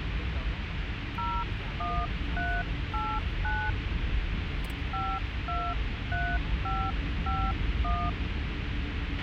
DTMF, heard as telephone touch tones, dialled by hand, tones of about 250 ms, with radio hiss, a squelch burst at the end and the noise inside a car. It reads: 01389 523551